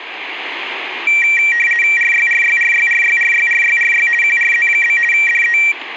RTTY (50 baud, 450 Hz shift), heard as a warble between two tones, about 2100 Hz centre, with radio static and room echo. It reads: RYRYRYRYRYRYRY QRZ? DE